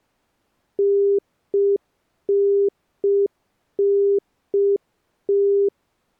Telephone call progress tone (UK plan), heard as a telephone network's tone, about 400 Hz. Congestion tone.